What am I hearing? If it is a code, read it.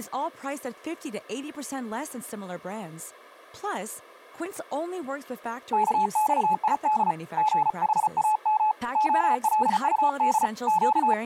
Morse code, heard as a keyed tone, hand-sent with a paddle, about 34 wpm, 860 Hz, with speech in English. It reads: KXID GHAM OLUD …